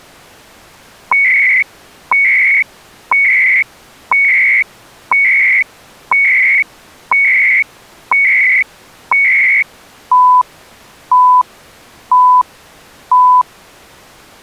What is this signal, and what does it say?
Radio time signal (CHU, Canada), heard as beeps and data bursts, one a second.